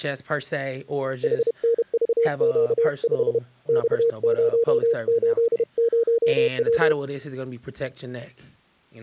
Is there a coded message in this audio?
Yes: Morse code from 1.2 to 7.0 s, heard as a keyed tone, hand-sent with a paddle, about 31 wpm, 460 Hz, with speech in English. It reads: HNVQ5 X080W